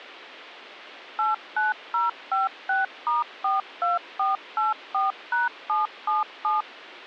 DTMF, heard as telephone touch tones, dialled by machine, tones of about 160 ms. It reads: 89056*42484#777